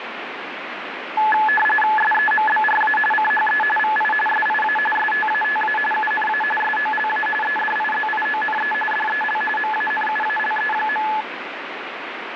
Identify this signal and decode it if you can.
RTTY (45.45 baud, 850 Hz shift), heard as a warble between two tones, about 1290 Hz centre, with radio static. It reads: SEMBRA CHE VI SIA STATA UNA SOLA EDIZIONE DEL MANUALE.